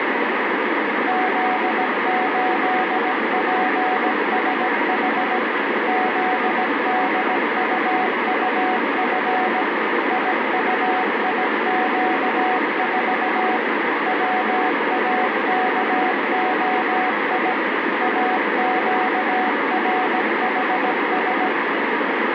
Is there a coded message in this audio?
Yes: Morse code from 1.0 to 21.5 s, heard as a keyed tone, machine-sent, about 17 wpm, 740 Hz, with heavy radio static. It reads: Z8PSH ZDUUF IUIQ4 WAKOI AQRHS